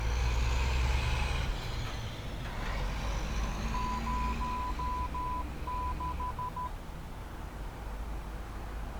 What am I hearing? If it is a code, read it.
Morse code, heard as a keyed tone, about 12 wpm, 1000 Hz, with street noise. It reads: 06